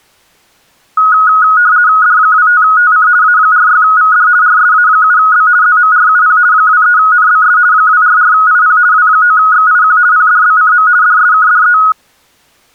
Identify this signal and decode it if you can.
RTTY (50 baud, 170 Hz shift), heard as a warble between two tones, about 1360 Hz centre. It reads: D25TC A46VD RSA7B ZMRUP 23NBS 244IP W9XIQ PDBCM DSKDE